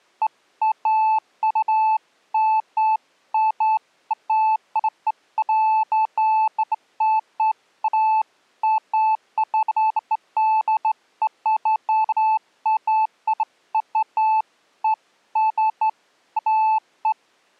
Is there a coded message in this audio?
No, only beeps of irregular length.